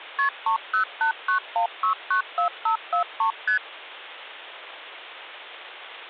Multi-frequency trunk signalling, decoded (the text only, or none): KP 30891694543 ST